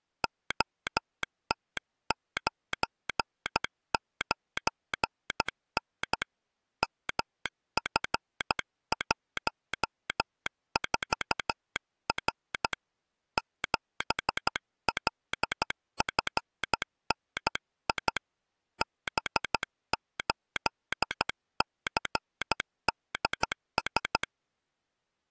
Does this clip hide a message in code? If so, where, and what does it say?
Yes: Morse code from 0.2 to 24.3 s, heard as a telegraph sounder, hand-sent with a paddle, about 13 wpm. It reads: OT99N MF14R 7LFNI B8CDS